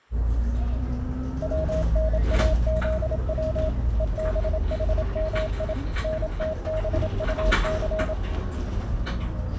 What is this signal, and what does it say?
Morse code (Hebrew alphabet), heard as a keyed tone, machine-sent, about 27 wpm, 630 Hz, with the noise inside a bus. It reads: צנאזץ ובחמי נתבטס